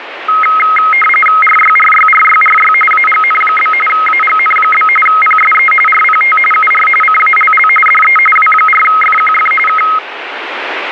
RTTY (45.45 baud, 850 Hz shift), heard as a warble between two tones, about 1700 Hz centre, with radio static. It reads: RYRYRYRY AGN? AGN? PSE RPT UR CALL DE W4FQF K